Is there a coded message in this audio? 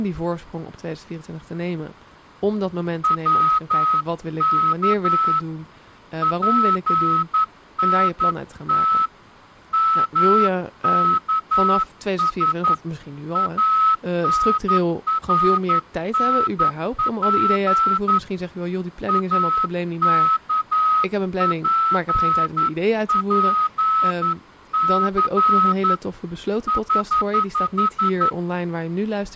Yes: Morse code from 3.0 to 28.4 s, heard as a whistle, hand-sent with a straight key, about 11 wpm, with speech in Dutch. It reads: WK PNT MKS ANRNP AKPPC <HH>